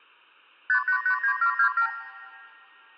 Multi-frequency trunk signalling (R2, with the far end's replies), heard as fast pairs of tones, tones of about 90 ms. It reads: 5889727